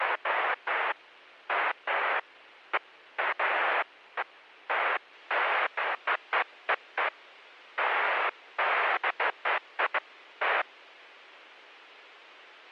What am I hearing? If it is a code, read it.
Bursts of noise. There is no code.